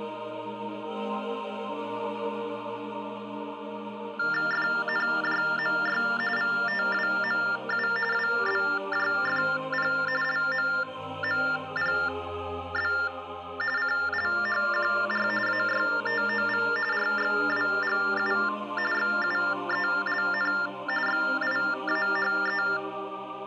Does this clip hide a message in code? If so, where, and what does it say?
Yes: TTY/TDD text telephone tones (45.45 baud Baudot) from 4.2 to 22.8 s, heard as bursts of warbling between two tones, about 400 Hz shift, 1600 Hz centre. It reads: FNJMY VTWMU WBJFP LMMPB CLHQR AYTOV RXWGU XUELN XIAHE